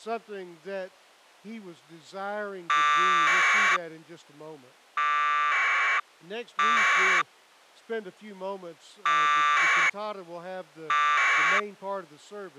Packet radio (AX.25, as in APRS), 1200 baud, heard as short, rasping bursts.